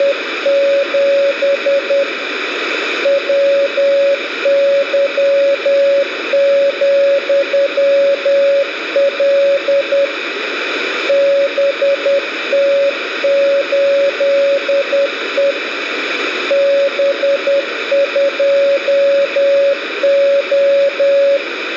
Morse code, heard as a keyed tone, hand-sent with a paddle, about 10 wpm, 560 Hz, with radio static and room echo. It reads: … WY,L BT8E B2O